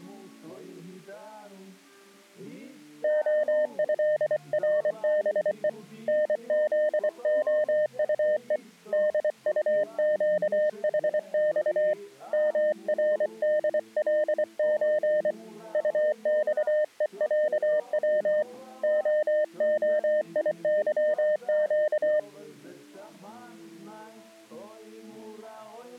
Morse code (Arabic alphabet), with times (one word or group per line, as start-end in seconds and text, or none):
3.0-5.7 خهربء
6.1-8.6 نذخطء
8.9-11.9 دطقحص
12.3-15.3 مردلز
15.7-18.4 طصءعو
18.8-22.2 خخيظق